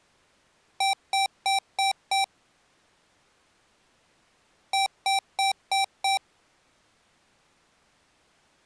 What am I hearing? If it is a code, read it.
Beep code, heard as beeps from a small speaker, played twice, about 780 Hz. 5 short. In AMI BIOS tables: processor failure; in Dell tables: CMOS battery failure.